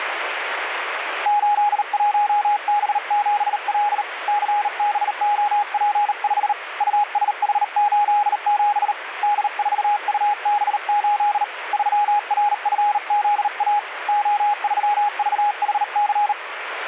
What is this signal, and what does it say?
Morse code, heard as a keyed tone, hand-sent with a bug key, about 38 wpm, 830 Hz, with radio static. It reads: 81B7L CBOP5 USH87 D4UB8 3RFZA O3VHC